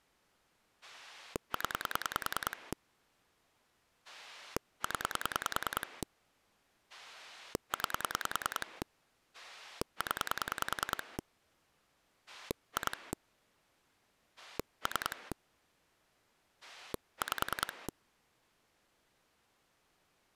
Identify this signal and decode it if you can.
Pulse dialling, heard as a rotary dial, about 10 pulses a second. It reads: 0 0 9 0 2 3 5